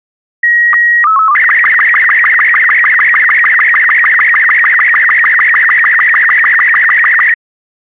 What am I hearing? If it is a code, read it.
SSTV (slow-scan television), Robot 36, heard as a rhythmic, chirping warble.